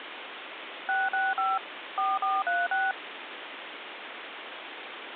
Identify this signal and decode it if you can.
DTMF, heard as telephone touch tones, dialled by machine, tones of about 200 ms, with phone line noise. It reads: 665 4436